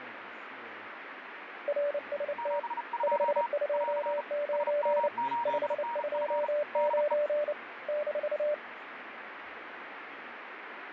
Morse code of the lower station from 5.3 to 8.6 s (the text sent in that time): 529 -